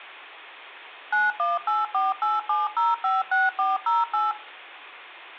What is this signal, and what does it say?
DTMF, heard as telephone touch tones, dialled by machine, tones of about 180 ms. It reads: 918487056408